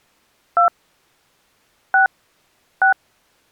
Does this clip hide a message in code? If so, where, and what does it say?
Yes: DTMF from 0.6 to 2.9 s, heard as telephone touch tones, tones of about 90 ms. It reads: 2 6 6